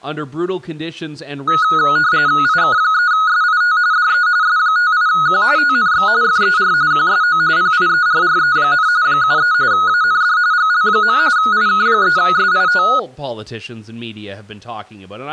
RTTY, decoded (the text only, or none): IK3SIT DE S58Q TNX FER QSO PIERRE, 73 AND GL. IK3SIT